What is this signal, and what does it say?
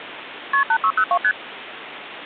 Multi-frequency trunk signalling (R1, as on North American trunks), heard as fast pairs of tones, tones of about 70 ms, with phone line noise. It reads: KP 8602 ST